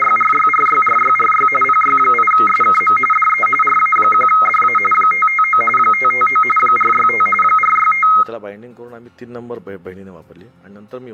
RTTY (45.45 baud, 850 Hz shift), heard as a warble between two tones, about 1700 Hz centre, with room echo. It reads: … PY8SKM DE RA1DA 559 559 465 465